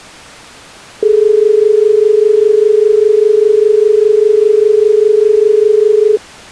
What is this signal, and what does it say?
Telephone call progress tone (as in Australia), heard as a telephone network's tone, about 430 Hz. Dial tone.